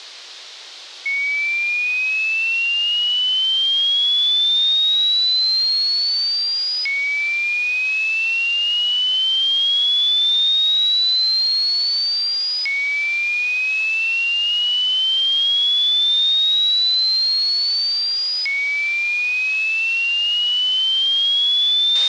A tone that sweeps in pitch again and again, with radio hiss and a squelch burst at the end. There is no code.